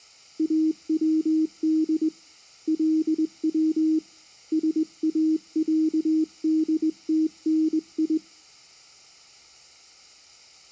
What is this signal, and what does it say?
Morse code (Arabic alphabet), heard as a keyed tone, hand-sent with a straight key, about 20 wpm, 320 Hz. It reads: اود لو ساعدتني